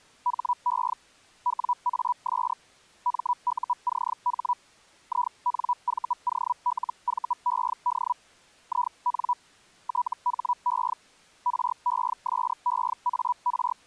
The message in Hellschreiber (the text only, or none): HE WAS MUCH INVOLVED IN THE …